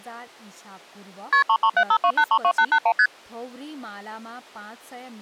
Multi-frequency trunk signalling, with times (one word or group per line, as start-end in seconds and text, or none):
1.3-1.4 KP
1.5-2.9 33752832881
3.0-3.1 ST